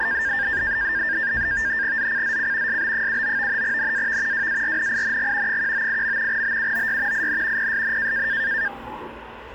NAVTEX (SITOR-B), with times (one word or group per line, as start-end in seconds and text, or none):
2.0-2.8 ZCZC
2.7-3.6 SB79
3.6-4.5 NAV
4.3-5.6 WARNING
5.5-6.4 198.
6.3-7.3 BUOY
7.1-7.7 IN
7.6-8.3 PSN